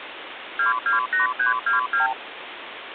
Multi-frequency trunk signalling (R2, with the far end's replies), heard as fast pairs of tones, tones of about 130 ms, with phone line noise. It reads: 228322